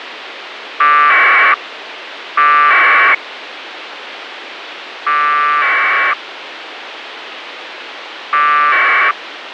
Packet radio (AX.25, as in APRS), 1200 baud, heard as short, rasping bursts, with radio hiss.